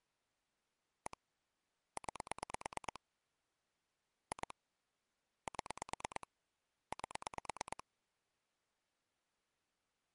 Pulse dialling, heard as clicks on a phone line, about 9 pulses a second. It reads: 1 9 2 7 8